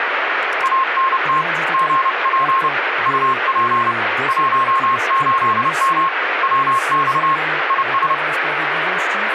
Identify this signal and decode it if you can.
Morse code, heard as a keyed tone, hand-sent with a paddle, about 30 wpm, 1070 Hz, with radio static and speech in Polish. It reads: ANT GP UP 18M WX IS